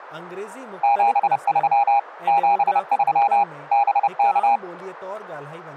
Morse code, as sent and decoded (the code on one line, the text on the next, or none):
--... ...-- / --... ...-- / -... -.-
73 73 BK